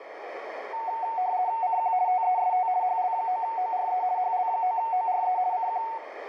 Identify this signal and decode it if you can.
RTTY (50 baud, 170 Hz shift), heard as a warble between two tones, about 820 Hz centre, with radio static, a narrow filter and room echo. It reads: CQ TEST HL9ORE HL9ORE CQ